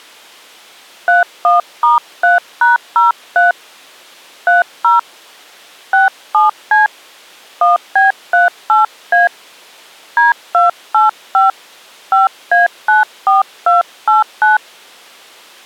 DTMF, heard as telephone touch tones, dialled by hand, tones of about 150 ms. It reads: 31*3#03 30 67C 1B38A D285 5A94289